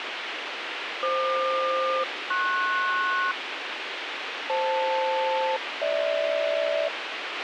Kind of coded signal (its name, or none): aircraft SELCAL